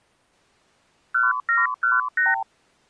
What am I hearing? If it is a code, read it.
Multi-frequency trunk signalling (R2, with the far end's replies), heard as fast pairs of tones, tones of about 170 ms. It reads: 1718